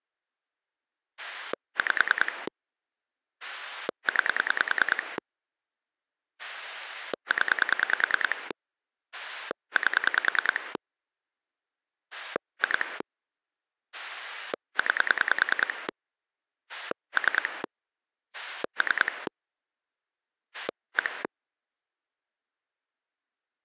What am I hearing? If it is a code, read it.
Pulse dialling, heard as a rotary dial, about 10 pulses a second. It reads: 5 9 0 8 2 9 3 3 1